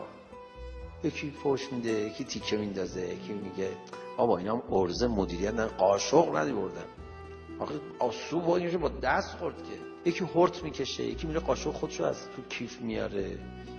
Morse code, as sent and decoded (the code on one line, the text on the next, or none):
none